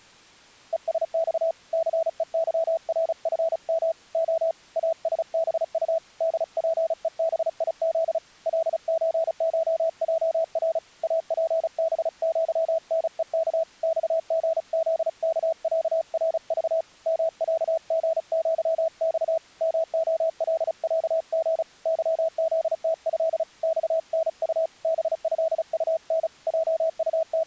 Morse code (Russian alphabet), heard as a keyed tone, hand-sent with a paddle, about 35 wpm, 650 Hz. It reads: ЕСЬ ЦЕЫРФМ О АСБУ ДПЕБИЗ ЛЧШЙР АПБЪНЕК ЬГЗКЯРЖ МЯГЪЬ МОЛЯГ ЫЗТЭ ЬНУ БЭУН …